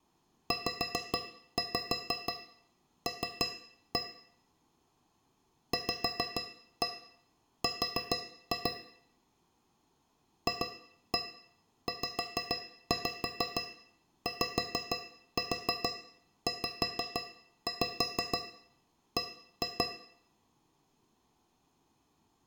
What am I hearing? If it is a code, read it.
Tap code, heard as taps on a metal pipe, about 6 knocks a second, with room echo. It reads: ZL VR FZYZB